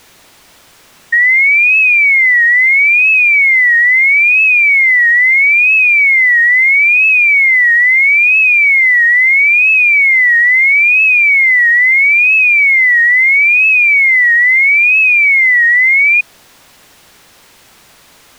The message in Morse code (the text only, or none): none